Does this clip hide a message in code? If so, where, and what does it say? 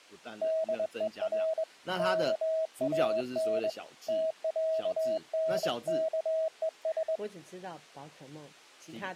Yes: Morse code (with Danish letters) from 0.4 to 7.2 s, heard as a keyed tone, hand-sent with a straight key, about 22 wpm, 640 Hz, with speech in Chinese. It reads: DER KAN TÆNKES